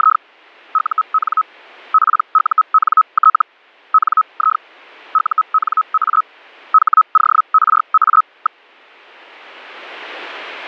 Hellschreiber (Feld-Hell, 122.5 baud), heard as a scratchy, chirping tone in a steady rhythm, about 1280 Hz. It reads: … UN PUNT NI UNA HORA.